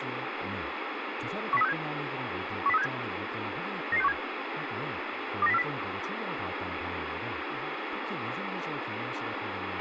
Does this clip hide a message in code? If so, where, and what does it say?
Yes: five-tone selective call (EEA) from 1.5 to 5.6 s, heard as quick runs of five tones, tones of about 40 ms, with radio hiss, a squelch burst at the end and speech in Korean. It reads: 10367 10367 99617 29040